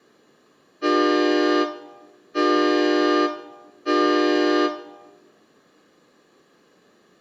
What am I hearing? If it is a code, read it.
Train horn signal, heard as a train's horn, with room echo. 3 short. On North American railways: when stopped, the train will back up.